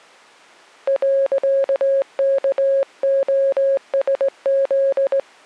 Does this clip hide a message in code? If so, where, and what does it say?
Yes: Morse code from 0.8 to 5.3 s, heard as a keyed tone, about 18 wpm, 550 Hz. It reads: .KOSZ